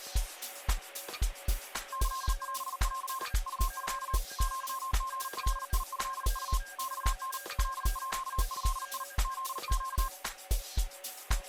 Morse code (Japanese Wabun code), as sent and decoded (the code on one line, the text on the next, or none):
-.-.. .-... .-.-. / ..- ..-.- / --.-- --. .-.. .. ..-.. ..- / -..- -. / .-.. .--.- ..-.. .. / --.. --.-
キオン ウミ アリガトウ マタ カード フネ